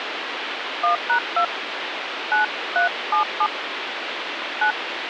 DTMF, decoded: 1#2 9377 9

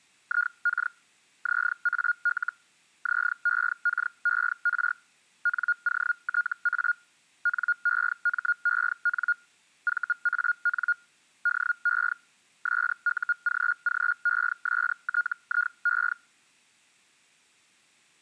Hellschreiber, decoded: IK ZAL ZEKER NOTA NEMEN VAN DE SUGGESTIE

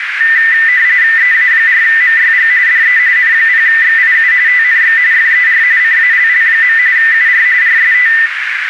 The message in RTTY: EA4MYG DE N0XIU TNX FER CALL. UR RST

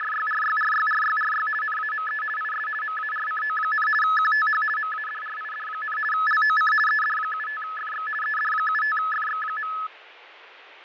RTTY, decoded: … NAME IS MARCO, QTH MADRID, LOC ED75FX ED75FX.

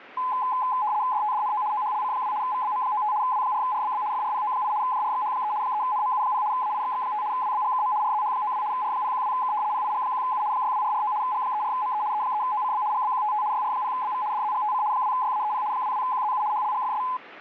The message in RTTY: DTDNO OHLC2 VBM95 W4RBB FRPO8 JRXH3 3NMU0 AIXX5 WBGKM RZH92 R012K PIG1U 62449 G34ME E3OCB GBQTT YR0BV DZGTC 2YAEP 22QZU HLGFS

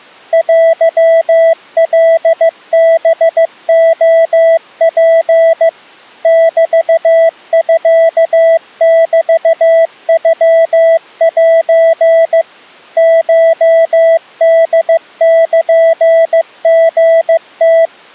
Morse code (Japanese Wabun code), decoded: テカハレツ メミメノセ コホルリム

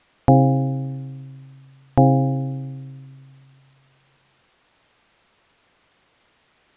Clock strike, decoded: 2

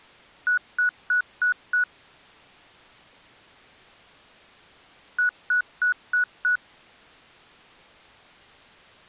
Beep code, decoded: 5 short

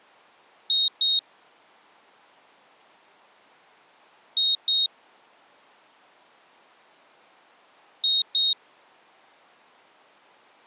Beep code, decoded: 2 short

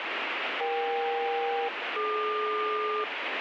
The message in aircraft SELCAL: EK-DQ

